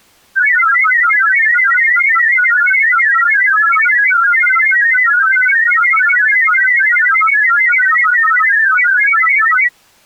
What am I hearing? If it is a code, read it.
Multi-tone FSK (Olivia or MFSK type), about 1000 Hz wide, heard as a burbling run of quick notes, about 31.25 baud.